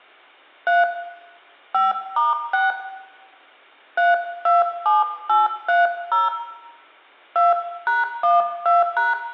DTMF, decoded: 3 5*6 327830 2#12#

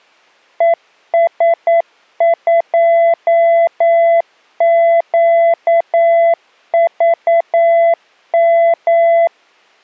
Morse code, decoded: ES2QVM

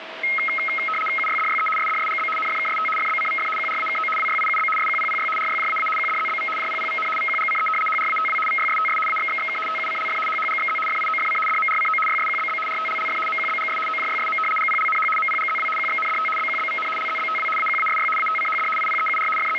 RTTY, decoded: UYDYE SDSGB NFKST FBCVF QRAKO WYIUB SQPPY RYJAA QDZBV JPPVN VQGCE HRATW VYSTS AXXXK TUCLF HHGXZ FIOFC DMRCO YSQBB RTLLF MQBGS OJYSM GPLNH MPGZW QXNDT BQBVN LZBTW AQASY ATCHD IPEUR …

